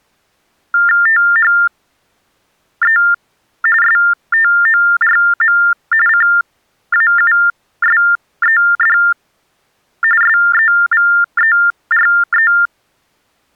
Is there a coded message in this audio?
Yes: TTY/TDD text telephone tones (45.45 baud Baudot) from 0.7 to 12.7 s, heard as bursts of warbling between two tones, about 400 Hz shift, 1600 Hz centre. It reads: THE STORM CAUSED SEVERE